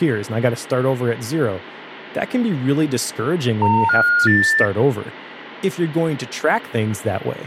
Telephone call progress tone (North American plan), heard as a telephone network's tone, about 910, 1430, 1800 Hz, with hum and speech in English. Special information tone.